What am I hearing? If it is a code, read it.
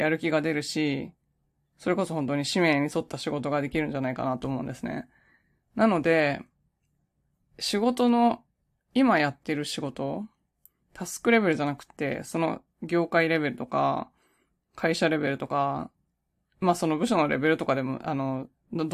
Speech in Japanese. There is no code.